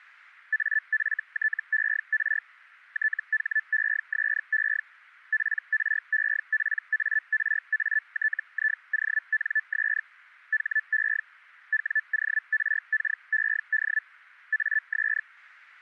Hellschreiber (Feld-Hell, 122.5 baud), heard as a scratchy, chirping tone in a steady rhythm, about 1750 Hz. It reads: AFTER THESE PREPARATIONS HE WORKED AS